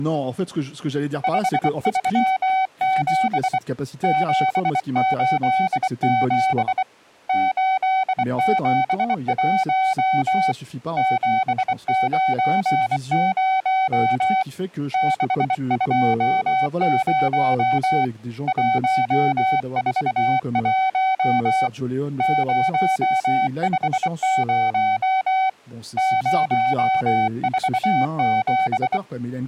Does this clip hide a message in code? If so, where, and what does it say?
Yes: Morse code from 1.2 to 29.0 s, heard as a keyed tone, hand-sent with a bug key, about 24 wpm, 760 Hz, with speech in French. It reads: 537 787 871 790 620 141 050 047